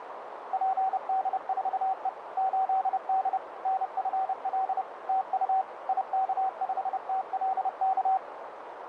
Morse code, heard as a keyed tone, machine-sent, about 30 wpm, 760 Hz, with radio static and a narrow filter. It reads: PD4E 8D NFL TU IK5TLK